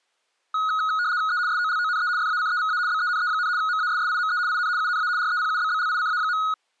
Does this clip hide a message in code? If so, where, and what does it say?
Yes: RTTY (75 baud, 170 Hz shift) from 0.5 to 6.5 s, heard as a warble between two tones, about 1360 Hz centre. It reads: E SOLONE FACEVA BENE, MASSIME IN UNA REPUBBLICA.